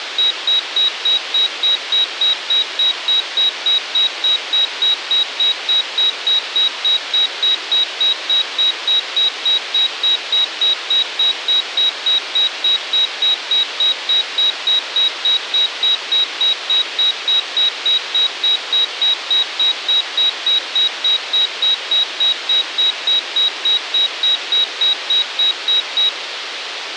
Evenly repeated beeps, with radio hiss. There is no code.